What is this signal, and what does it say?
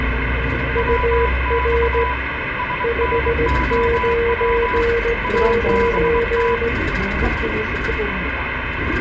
Morse code, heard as two keyed tones, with radio static and the noise inside a bus. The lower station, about 17 wpm, 470 Hz: UR 599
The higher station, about 23 wpm, 990 Hz: WX SNOW ABT